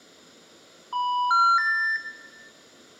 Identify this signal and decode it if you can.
Telephone call progress tone (North American plan), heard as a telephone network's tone, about 980, 1370, 1800 Hz, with room echo. Special information tone.